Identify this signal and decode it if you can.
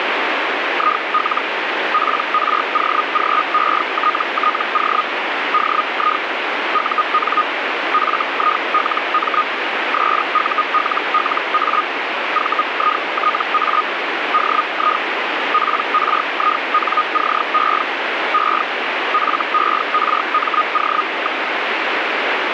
Hellschreiber (Feld-Hell, 122.5 baud), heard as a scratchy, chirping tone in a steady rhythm, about 1240 Hz, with radio static. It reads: IL PROGETTO DI UN FILM SULLA VITA DI PRINCE E FERMO.